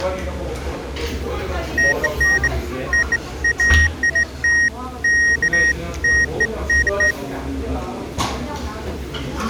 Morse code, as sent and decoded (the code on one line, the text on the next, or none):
none